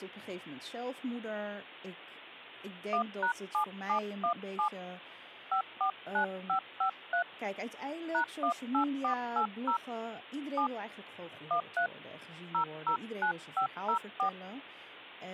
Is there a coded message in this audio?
Yes: DTMF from 2.9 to 14.3 s, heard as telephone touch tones, dialled by hand, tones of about 100 ms, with speech in Dutch. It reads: 1#7717 549553 #18480 7 13 009504